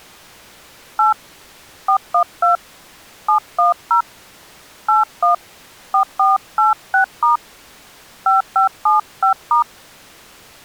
DTMF, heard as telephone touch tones, dialled by hand, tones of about 130 ms. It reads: 8 412 710 81 4486* 5575*